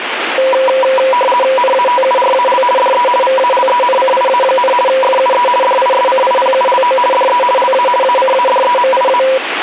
RTTY (50 baud, 450 Hz shift), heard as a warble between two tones, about 750 Hz centre, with radio static. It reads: NATURAL DE VALENCIA, FUE DISCIPULO DE LA ACADEMIA